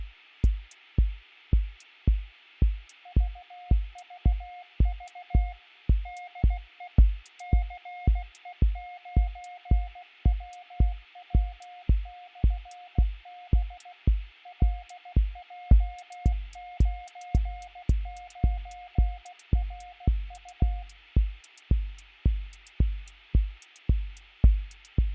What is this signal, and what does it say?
Morse code, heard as a keyed tone, machine-sent, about 16 wpm, 720 Hz, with radio static. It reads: VVV DE CE9WW/B LJ99RU